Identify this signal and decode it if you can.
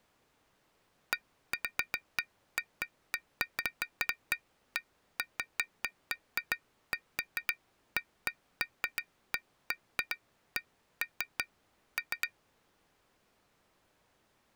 Irregular taps on glass. There is no code.